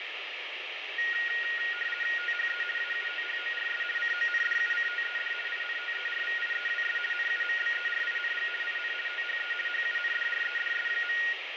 RTTY (50 baud, 450 Hz shift), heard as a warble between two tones, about 1650 Hz centre, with radio static. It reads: THE AUTHORS CONDUCTED INTERVIEWS NUMBERING IN THE HUNDREDS.